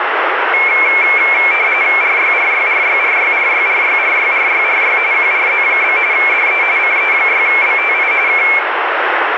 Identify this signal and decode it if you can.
RTTY (45.45 baud, 170 Hz shift), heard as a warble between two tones, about 2250 Hz centre, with radio static and room echo. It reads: RYRYRYRYRYRYRYRYRY QRZ? DE CE6BTI K